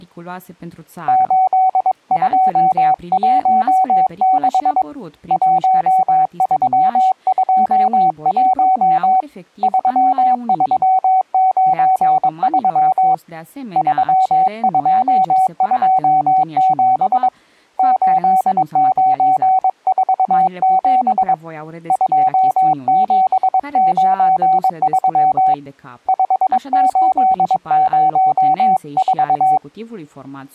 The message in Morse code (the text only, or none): 8216 1321 3393 3227 8947 2793 5804